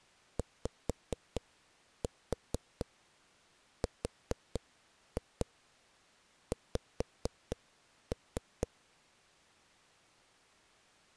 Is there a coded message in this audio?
Yes: tap code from 0.4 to 8.7 s, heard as knocks on a wall, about 4 knocks a second. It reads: YRX